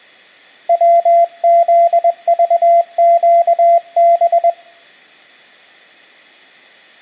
Morse code, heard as a keyed tone, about 21 wpm, 680 Hz, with room echo. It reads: WZVQB